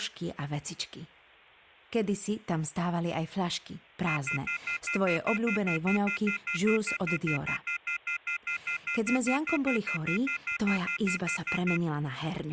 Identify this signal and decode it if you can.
Telephone call progress tone (North American plan), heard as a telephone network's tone, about 1400, 2050, 2450, 2600 Hz, 0.1 s on and 0.1 s off, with speech in Slovak. Off-hook warning tone.